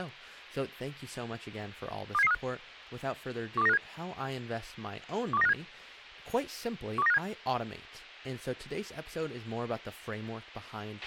Five-tone selective call (EEA), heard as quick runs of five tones, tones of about 40 ms, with a squelch burst at the end and speech in English. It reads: 27735 12957 12957 12957